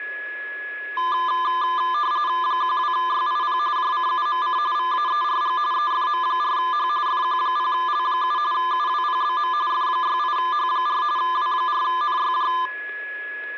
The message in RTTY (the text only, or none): 12YIP JCUMC VAERG EFM4H FQ0L7 UWPBM F68H4 W4NYJ